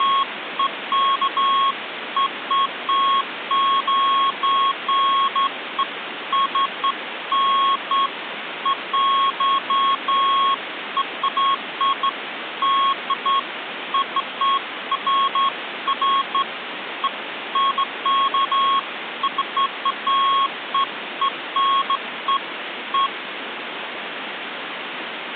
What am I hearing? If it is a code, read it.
Beeps of irregular length, with phone line noise. There is no code.